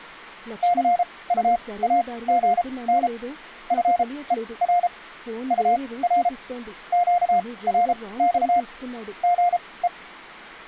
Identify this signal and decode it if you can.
Morse code, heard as a keyed tone, machine-sent, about 33 wpm, spaced as for 21 wpm, 710 Hz, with speech in Telugu. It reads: CUAGN FER UR QRX GE